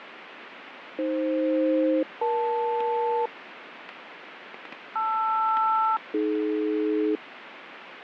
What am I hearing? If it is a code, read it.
Aircraft SELCAL, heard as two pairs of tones, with radio static. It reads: AF-EL LR-AD